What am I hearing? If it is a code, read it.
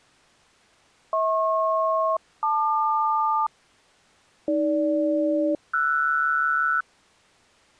Aircraft SELCAL, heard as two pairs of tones. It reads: HP-LQ AG-RS